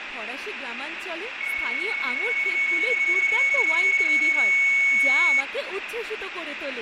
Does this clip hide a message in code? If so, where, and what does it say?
Yes: PSK31 (31.25 baud) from 1.4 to 5.4 s, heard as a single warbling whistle, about 2200 Hz, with radio static, room echo and speech in Bangla.